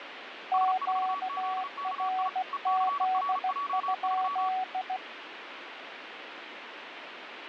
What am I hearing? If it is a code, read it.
Morse code, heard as two keyed tones, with radio static. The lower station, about 16 wpm, 750 Hz: QRZ?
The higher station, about 35 wpm, 1140 Hz: S4ZKI ECRJ3